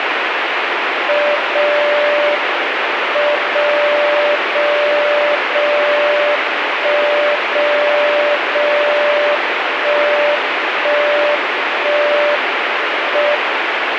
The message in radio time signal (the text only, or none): 0 M 0 0 0 1 0 0 1 1 1 M